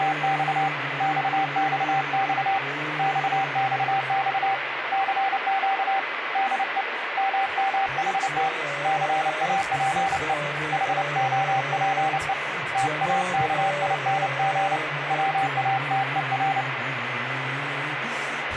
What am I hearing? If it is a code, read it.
Morse code, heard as a keyed tone, hand-sent with a paddle, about 29 wpm, 780 Hz, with radio static. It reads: … XXX XXX CQ DE MMHT CAPE HOPE TAKING WATER